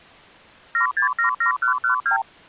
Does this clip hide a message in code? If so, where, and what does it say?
Yes: multi-frequency trunk signalling (R2, with the far end's replies) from 0.7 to 2.2 s, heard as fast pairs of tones, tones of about 110 ms. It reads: 7677112